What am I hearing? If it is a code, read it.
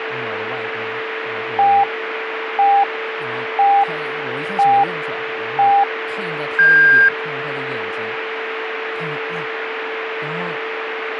Radio time signal (five pips and a higher one, as on Chinese radio), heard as pips, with radio static, a steady whistle near 450 Hz and speech in Chinese.